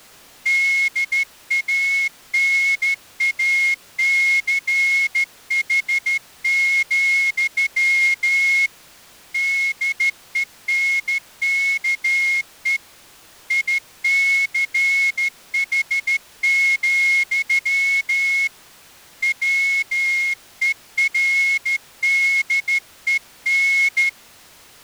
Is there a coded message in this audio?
Yes: Morse code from 0.4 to 24.2 s, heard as a whistle, hand-sent with a straight key, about 13 wpm. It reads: DANACH, DENKE ICH, WERDEN